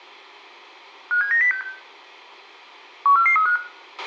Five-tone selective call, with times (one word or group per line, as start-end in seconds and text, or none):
1.1-1.6 57906
3.1-3.6 14435